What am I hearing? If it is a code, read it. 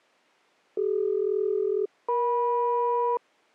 Aircraft SELCAL, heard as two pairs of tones. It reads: CD-EM